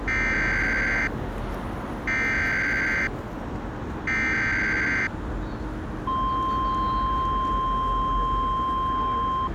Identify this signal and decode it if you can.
Emergency Alert System (SAME) tones (header bursts, then the 1050 Hz attention tone), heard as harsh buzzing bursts, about 520.83 baud, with street noise.